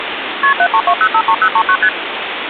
Multi-frequency trunk signalling (R1, as on North American trunks), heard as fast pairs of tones, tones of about 70 ms, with phone line noise. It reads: KP 732053039 ST